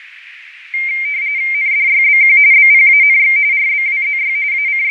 RTTY (45.45 baud, 170 Hz shift), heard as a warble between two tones, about 2200 Hz centre, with radio static and fading. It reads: NDYBQ BPANX RBWZY …